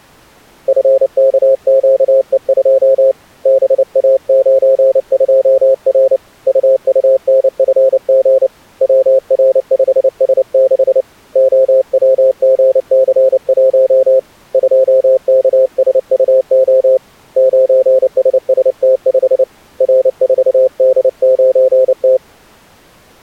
Morse code, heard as a keyed tone, hand-sent with a paddle, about 29 wpm, 530 Hz. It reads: FKQE2 BA92R UUNFG WR5S6 OWGC1 2KSUO 9SST5 R4D9T